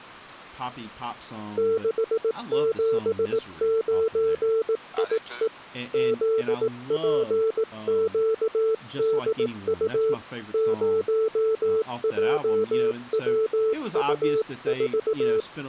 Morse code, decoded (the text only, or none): 679IE ZPQDU 0JWU4